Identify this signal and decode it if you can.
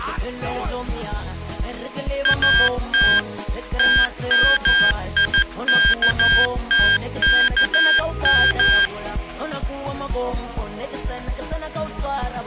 Morse code (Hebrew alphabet), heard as electronic beeps, machine-sent, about 14 wpm, 1600 Hz. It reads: את תמיכתכם